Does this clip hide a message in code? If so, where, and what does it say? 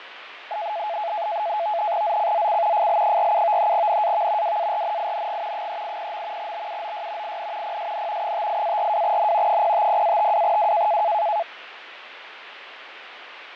Yes: NAVTEX (SITOR-B), 100 baud, 170 Hz shift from 0.5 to 11.4 s, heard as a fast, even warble, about 760 Hz centre, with radio static and fading. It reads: ZCZC FL47 NAV WARNING 380. BUOY IN PSN 58-42N 050-52W